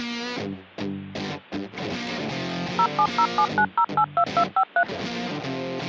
DTMF, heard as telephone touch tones, dialled by machine, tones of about 70 ms. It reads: 07079082253